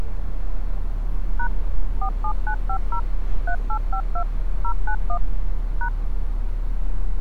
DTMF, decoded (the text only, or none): # 47950 3852 091 #